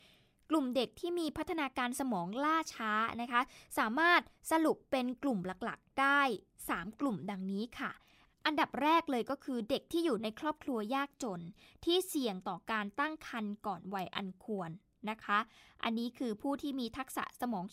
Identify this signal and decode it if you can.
Speech in Thai. There is no code.